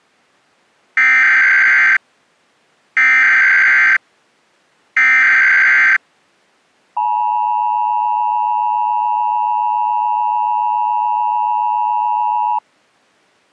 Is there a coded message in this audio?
Yes: Emergency Alert System (SAME) tones (header bursts, then the 853 and 960 Hz attention tone) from 1.0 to 12.6 s, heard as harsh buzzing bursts, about 520.83 baud.